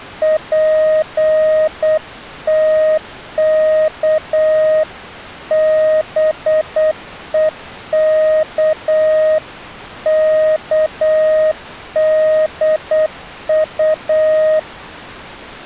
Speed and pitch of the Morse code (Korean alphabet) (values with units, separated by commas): 8 wpm, 620 Hz